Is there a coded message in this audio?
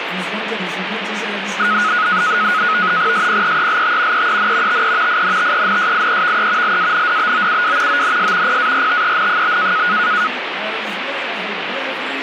Yes: NAVTEX (SITOR-B), 100 baud, 170 Hz shift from 1.6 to 10.3 s, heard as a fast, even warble, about 1360 Hz centre, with radio static. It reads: SPEELT EEN TE INTENSIEVE LANDBOUW ONS PARTEN?